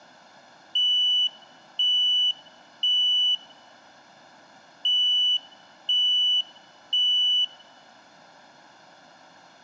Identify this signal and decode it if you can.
Alarm pattern, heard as an alarm's beeps, played twice, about 2950 Hz, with room echo. Temporal three. Smoke or fire, evacuate.